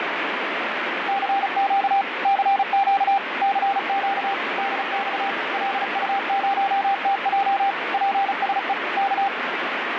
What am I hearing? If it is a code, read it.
Morse code, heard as a keyed tone, machine-sent, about 35 wpm, 790 Hz, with heavy radio static. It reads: CQ CQ CQ DX LU0TJ PSE K